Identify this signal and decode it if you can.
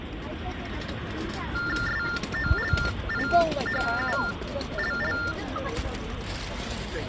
TTY/TDD text telephone tones (45.45 baud Baudot), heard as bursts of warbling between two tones, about 400 Hz shift, 1600 Hz centre, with phone line noise and the noise of a park. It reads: SOLIHULL